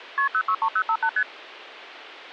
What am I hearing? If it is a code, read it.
Multi-frequency trunk signalling (R1, as on North American trunks), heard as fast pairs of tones, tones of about 70 ms. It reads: KP 063058 ST